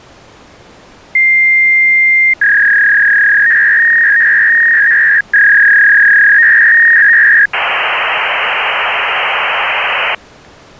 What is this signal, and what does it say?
Fax machine handshake, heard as a long tone, a warble and hiss.